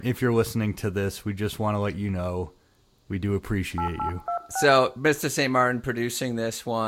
DTMF, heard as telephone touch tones, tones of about 100 ms, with room echo and speech in English. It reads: 8826